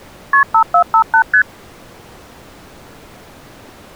Multi-frequency trunk signalling (R1, as on North American trunks), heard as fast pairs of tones, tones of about 80 ms. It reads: KP 5458 ST